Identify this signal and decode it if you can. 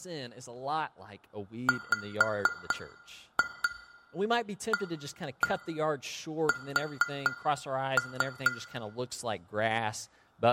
Tap code, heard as taps on glass, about 4 knocks a second, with room echo and speech in English. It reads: WAS